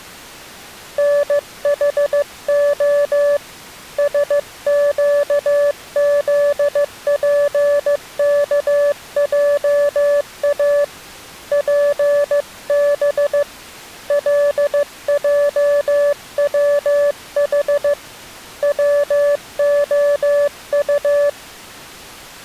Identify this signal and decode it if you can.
Morse code, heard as a keyed tone, hand-sent with a paddle, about 15 wpm, 580 Hz. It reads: NHO SQZPKJA PB LJWH WOU